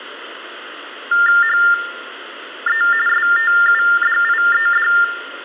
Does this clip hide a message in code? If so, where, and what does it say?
Yes: TTY/TDD text telephone tones (45.45 baud Baudot) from 1.1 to 5.0 s, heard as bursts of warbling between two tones, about 400 Hz shift, 1600 Hz centre, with phone line noise and room echo. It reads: HE STUDIED